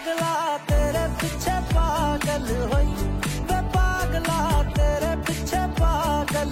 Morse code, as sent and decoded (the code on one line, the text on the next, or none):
none